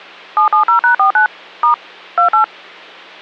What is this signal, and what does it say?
DTMF, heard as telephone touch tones, dialled by machine, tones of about 110 ms, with hum. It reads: 770#49 * 28